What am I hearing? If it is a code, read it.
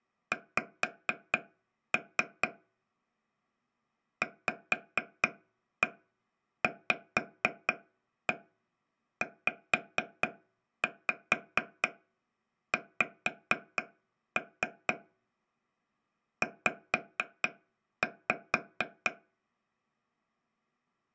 Tap code, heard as taps on a table, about 4 knocks a second. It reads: X VVZX Z